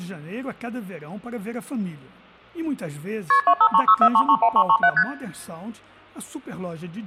Multi-frequency trunk signalling (R1, as on North American trunks), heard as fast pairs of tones, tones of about 70 ms, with hum. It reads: KP 25364331337 ST